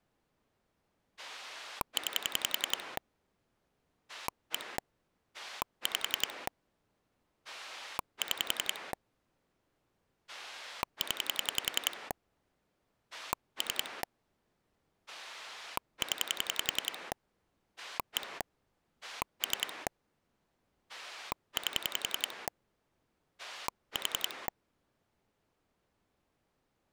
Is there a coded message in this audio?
Yes: pulse dialling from 1.2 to 24.5 s, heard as a rotary dial, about 10 pulses a second. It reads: 9 1 5 6 0 3 0 1 3 8 4